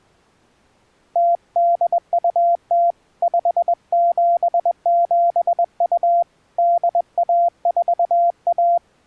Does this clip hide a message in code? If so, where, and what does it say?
Yes: Morse code (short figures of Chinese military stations) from 1.1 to 8.8 s, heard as a keyed tone, hand-sent with a paddle, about 21 wpm, 690 Hz. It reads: 0820 5772 8141